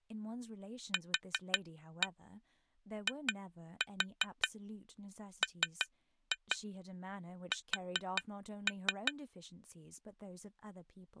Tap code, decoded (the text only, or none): QIMS